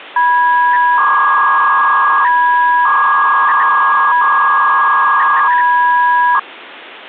300-baud modem data (V.21 tones), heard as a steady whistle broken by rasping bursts, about 300 baud, 200 Hz shift.